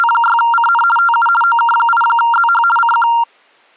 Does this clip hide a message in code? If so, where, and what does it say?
Yes: RTTY (50 baud, 450 Hz shift) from 0.0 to 3.2 s, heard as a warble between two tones, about 1160 Hz centre. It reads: … TU OK8ZH CQ